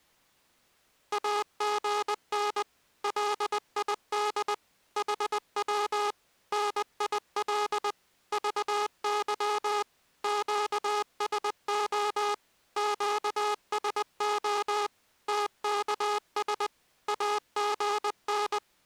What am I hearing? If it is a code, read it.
Morse code, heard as a buzzer, machine-sent, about 20 wpm. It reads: AGN LID HW NIL VY QSO QSO TKS AGN